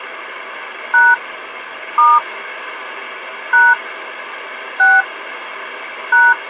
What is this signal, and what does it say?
DTMF, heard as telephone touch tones, dialled by hand, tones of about 210 ms, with phone line noise. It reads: # * # 6 #